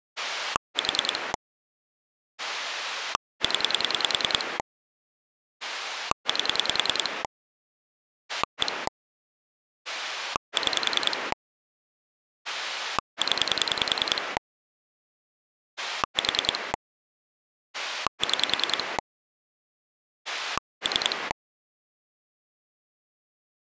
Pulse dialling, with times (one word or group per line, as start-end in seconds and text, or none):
0.2-1.3 4
2.4-4.6 0
5.6-7.2 8
8.3-8.9 1
9.9-11.3 6
12.4-14.4 0
15.8-16.7 4
17.7-19.0 6
20.3-21.3 3